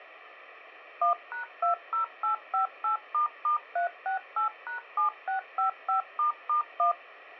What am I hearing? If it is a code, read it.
DTMF, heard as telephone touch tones, dialled by machine, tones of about 120 ms. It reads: 1#20858**368#7655**1